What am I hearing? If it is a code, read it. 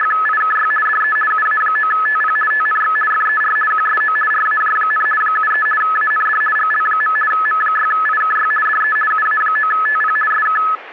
RTTY (50 baud, 450 Hz shift), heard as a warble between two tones, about 1500 Hz centre, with static crashes. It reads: … DE UA9TP TNX FER QSO RAJ, 73 AND GL. M6IKY DE UA9TP SK